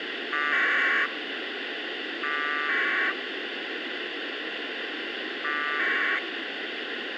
Packet radio (AX.25, as in APRS), 1200 baud, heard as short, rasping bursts, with radio hiss and a squelch burst at the end.